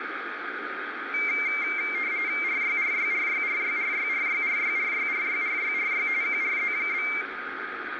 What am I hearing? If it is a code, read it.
RTTY (45.45 baud, 170 Hz shift), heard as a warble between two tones, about 2200 Hz centre, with radio static, a steady whistle near 1240 Hz and room echo. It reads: RYRYRYRYRYRYRYRYRYRYRY QRZ?